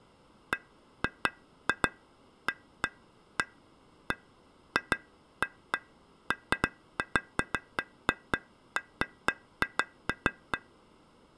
Irregular taps on glass. There is no code.